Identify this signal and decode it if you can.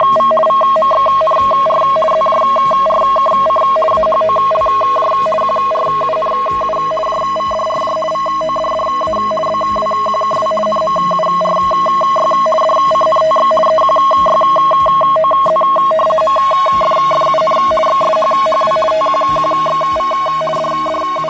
RTTY (50 baud, 450 Hz shift), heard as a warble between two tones, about 860 Hz centre, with fading. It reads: … VMXNR ZJRKC AHOLJ QRUNU JVDRJ VODDA BWQKW NMURY DCNTX EQYOZ MFFUN XSHHW TQQXV …